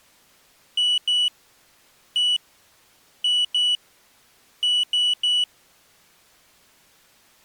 Beep code, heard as a piezo beeper, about 2950 Hz. 2-1-2-3. In Phoenix BIOS tables: ROM copyright notice check failure.